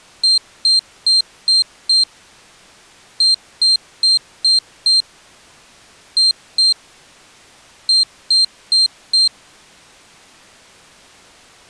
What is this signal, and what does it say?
Beep code, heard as a piezo beeper, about 4150 Hz. 5-5-2-4.